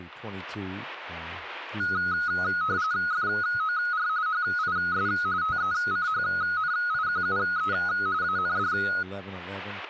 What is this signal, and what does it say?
RTTY (45.45 baud, 170 Hz shift), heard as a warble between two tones, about 1360 Hz centre, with speech in English. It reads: FOR HIS TECHNIQUE AND